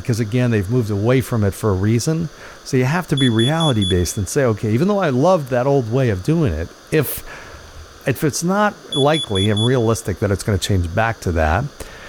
Alarm pattern, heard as an alarm's beeps, played twice, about 3400 Hz, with room echo and speech in English. Temporal four. Carbon monoxide.